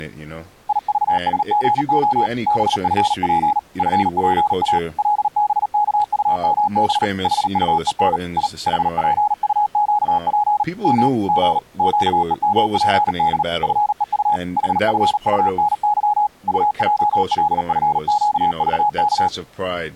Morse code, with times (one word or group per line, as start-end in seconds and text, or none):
0.7-2.3 IVSGO
2.5-3.6 BFP
3.8-4.8 FPA
5.0-7.0 LBKUMB
7.2-8.2 HUEN
8.4-8.5 I
8.7-10.6 HPUQP
10.8-11.1 M
11.3-11.6 G
11.8-13.4 QEMPD
13.6-14.4 FEU
14.6-16.3 HFUNY
16.5-19.3 UJLFQVK